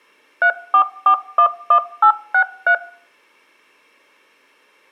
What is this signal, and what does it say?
DTMF, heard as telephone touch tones, dialled by machine, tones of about 80 ms. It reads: 34411863